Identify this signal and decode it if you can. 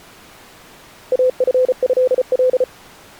Morse code (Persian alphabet), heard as a keyed tone, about 34 wpm, 510 Hz. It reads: افضل